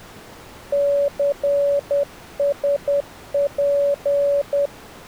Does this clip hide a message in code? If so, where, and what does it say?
Yes: Morse code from 0.7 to 4.7 s, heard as a keyed tone, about 10 wpm, 570 Hz. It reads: CSP